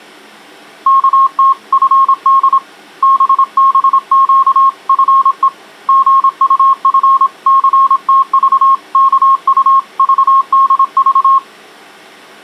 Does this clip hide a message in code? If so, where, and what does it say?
Yes: Morse code (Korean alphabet) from 0.8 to 11.4 s, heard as a keyed tone, hand-sent with a paddle, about 26 wpm, 1080 Hz. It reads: 어느 때나 신철이를